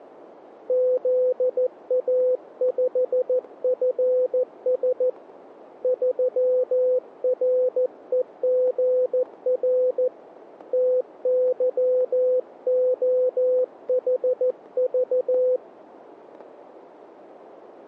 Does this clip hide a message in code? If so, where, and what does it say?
Yes: Morse code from 0.6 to 15.6 s, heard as a keyed tone, hand-sent with a paddle, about 14 wpm, 510 Hz, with static crashes. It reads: ZA5FS 3REGR TYOHV